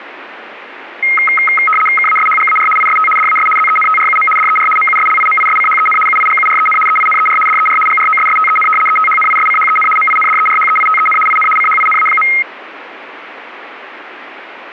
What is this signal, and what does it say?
RTTY (75 baud, 850 Hz shift), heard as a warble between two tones, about 1700 Hz centre, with radio static. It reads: KASHGAR IST DAS ZENTRUM DER MUSLIMISCHEN UIGUREN EINER DER GROSSTEN ETHNISCHEN MINDERHEITEN IN CHINA.